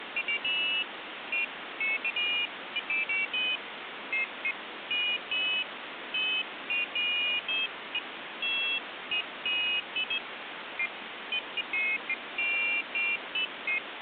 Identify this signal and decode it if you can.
Pairs of high tones at irregular times, with phone line noise. There is no code.